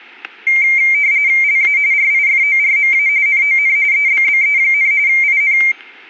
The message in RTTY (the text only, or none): LA RIFORMA NON EBBE, IN